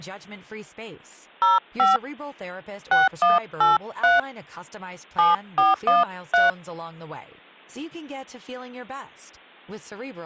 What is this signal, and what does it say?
DTMF, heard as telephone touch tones, dialled by hand, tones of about 160 ms, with speech in Swedish. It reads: 05 6183 7413